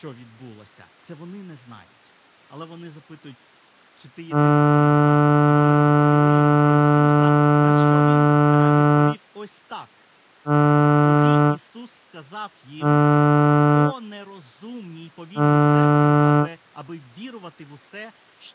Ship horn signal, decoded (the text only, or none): 1 long, 3 short